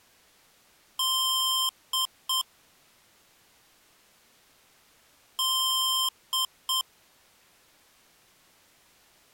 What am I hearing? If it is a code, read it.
Beep code, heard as beeps from a small speaker, played twice, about 1050 Hz. 1 long, 2 short. In Award, IBM and AMI BIOS tables: video adapter failure.